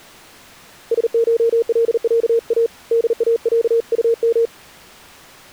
Morse code (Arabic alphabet), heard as a keyed tone, hand-sent with a paddle, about 39 wpm, 460 Hz. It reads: سشلعا داعطم